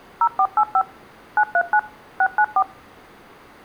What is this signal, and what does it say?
DTMF, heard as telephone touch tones, dialled by machine, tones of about 60 ms. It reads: 0485 939 694